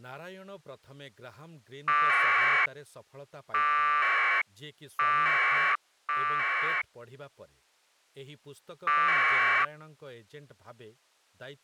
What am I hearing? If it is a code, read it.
Packet radio (AX.25, as in APRS), 1200 baud, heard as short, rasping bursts, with speech in Odia.